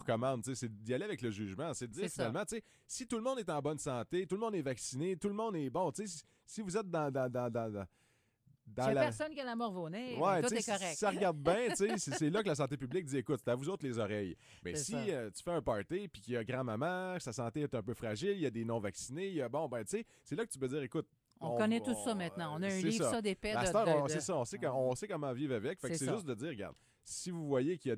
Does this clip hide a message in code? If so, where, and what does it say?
No.